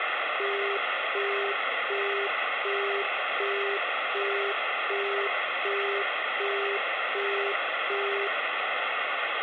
Telephone call progress tone (as in the UK, Australia and similar networks), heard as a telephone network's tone, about 400 Hz, 0.375 s on and 0.375 s off, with phone line noise. Busy tone.